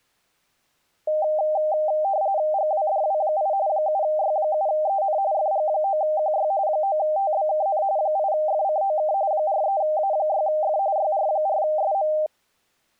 RTTY (45.45 baud, 170 Hz shift), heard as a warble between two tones, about 700 Hz centre. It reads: GWDW8 7Y7EN FG9QY 9TBKN 8FCOK 43A6F YR4SM